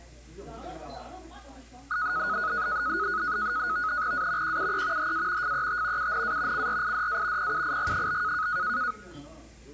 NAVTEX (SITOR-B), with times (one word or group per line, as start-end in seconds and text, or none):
4.1-4.6 A
4.4-5.1 QUE
5.0-5.5 HA
5.4-6.1 FET
6.0-6.7 UNA
6.5-7.5 CRIDA
7.4-8.5 PUIG?